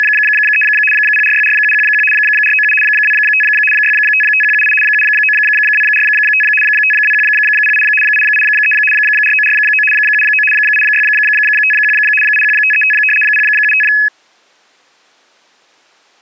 RTTY (75 baud, 850 Hz shift), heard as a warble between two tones, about 2150 Hz centre. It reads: … 0464711 497 25 655178 79245 52108 883 4949 79 8651 81535 075